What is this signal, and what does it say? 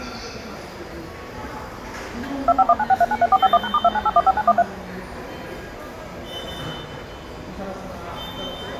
DTMF, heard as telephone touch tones, dialled by machine, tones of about 40 ms, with the noise of a subway station. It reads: 25196393451#*29815913